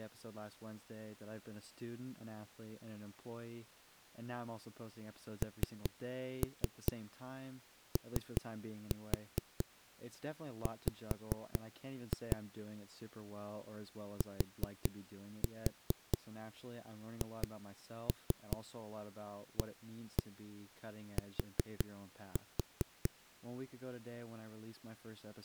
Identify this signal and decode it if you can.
Tap code, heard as knocks on a wall, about 5 knocks a second, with speech in English. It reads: NOW THAT